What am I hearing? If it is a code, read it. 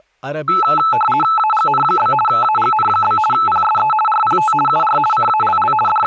RTTY (50 baud, 450 Hz shift), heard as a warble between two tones, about 1090 Hz centre, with speech in Urdu. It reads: AGN? AGN? PSE RPT UR CALL …